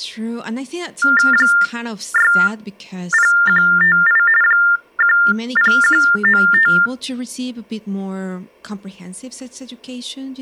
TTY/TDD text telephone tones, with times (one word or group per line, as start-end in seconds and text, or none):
1.3-4.2 60158
4.4-6.7 10195